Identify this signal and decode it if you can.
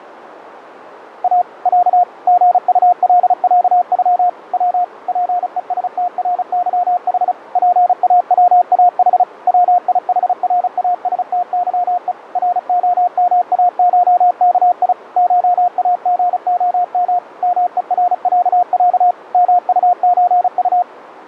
Morse code (Russian alphabet), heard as a keyed tone, machine-sent, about 35 wpm, 710 Hz, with radio static. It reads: А Я ГУЛЯЮ В ПЕСТРЫХ ПАВАХ ВИХРАСТЫЕ РОМАШКИ ШАГОМ МЕРЯЯ МУЧУ